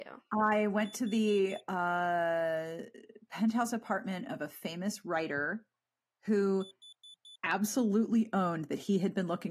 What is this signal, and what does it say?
Alarm pattern, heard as an alarm's beeps, played twice, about 3500 Hz, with speech in English. Temporal four. Carbon monoxide.